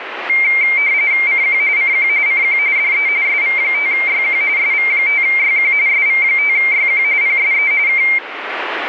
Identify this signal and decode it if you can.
RTTY (45.45 baud, 170 Hz shift), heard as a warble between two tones, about 2200 Hz centre, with radio static. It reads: CQ CQ CQ DE SV5YQ SV5YQ SV5YQ PSE K